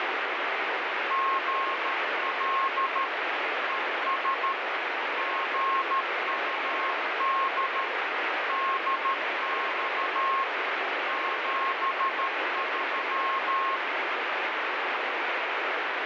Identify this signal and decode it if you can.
Morse code, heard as a keyed tone, machine-sent, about 13 wpm, 1080 Hz, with heavy radio static. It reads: GL ES GUD DX 73